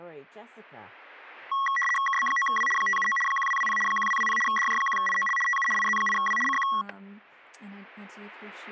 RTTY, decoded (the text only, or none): KB9W 579 1220 1220 DJ1IOL TU IZ8W CQ